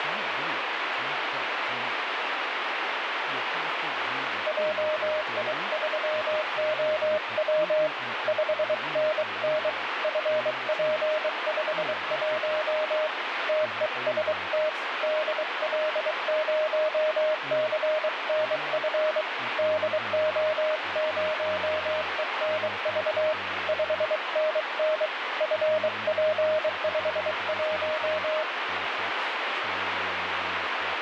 Morse code, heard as a keyed tone, hand-sent with a bug key, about 23 wpm, 620 Hz, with radio static and speech in English. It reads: JI3OW 5NN FP51 TEST DL0CNF DO0ENV 5NN FP51